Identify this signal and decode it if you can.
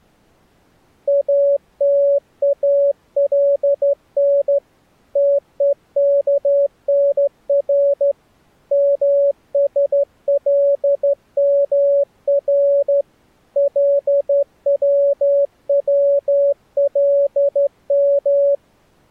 Morse code, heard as a keyed tone, hand-sent with a straight key, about 13 wpm, 560 Hz. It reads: ATALN TEKNR MSLMR LWWLM